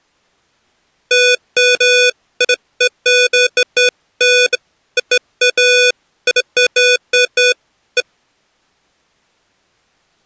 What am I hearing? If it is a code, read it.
Beeps of irregular length. There is no code.